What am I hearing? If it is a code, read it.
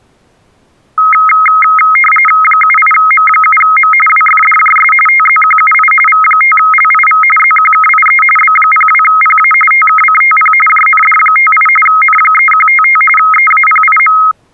RTTY (45.45 baud, 850 Hz shift), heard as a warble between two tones, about 1700 Hz centre. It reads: 78M7M WFDJS TZQUI V5LIV ZQKIE B02PA TKCTP JND58 N3155 EAPIM